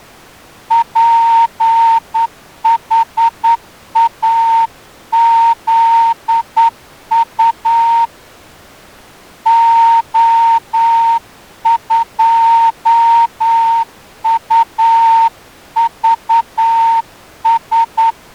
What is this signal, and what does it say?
Morse code, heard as a whistle, hand-sent with a straight key, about 9 wpm. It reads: PHAZU O2UVS